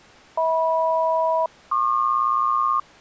Aircraft SELCAL, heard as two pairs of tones. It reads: HM-PQ